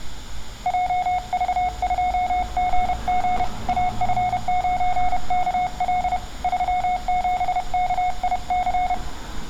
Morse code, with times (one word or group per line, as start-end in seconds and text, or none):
0.7-3.4 JV2GG
3.7-6.2 AF9KL
6.4-8.9 37KIC